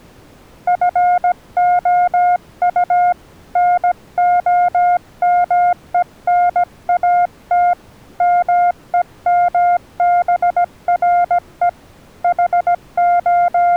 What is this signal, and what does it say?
Morse code, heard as a keyed tone, hand-sent with a paddle, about 17 wpm, 710 Hz. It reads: FOU NOMENAT MEMBRE …